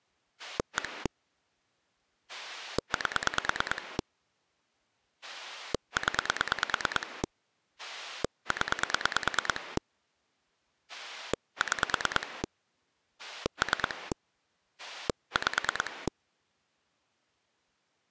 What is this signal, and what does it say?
Pulse dialling, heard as a rotary dial, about 9 pulses a second. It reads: 1 8 0 0 6 3 5